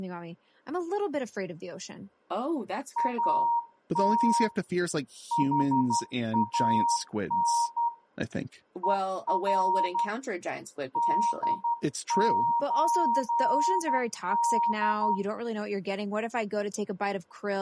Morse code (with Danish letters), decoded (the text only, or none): AT HAN ER DØD